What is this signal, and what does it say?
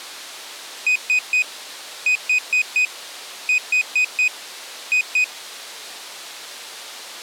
Beep code, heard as a piezo beeper, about 2500 Hz. 3-4-4-2.